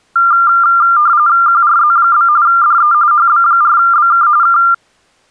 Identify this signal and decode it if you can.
RTTY (45.45 baud, 170 Hz shift), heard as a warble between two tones, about 1290 Hz centre. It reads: QRZ? DE HB4BK K